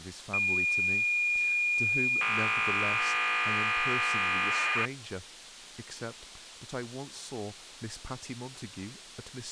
Cassette data (Kansas City type), 1200 baud, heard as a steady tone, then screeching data, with speech in English.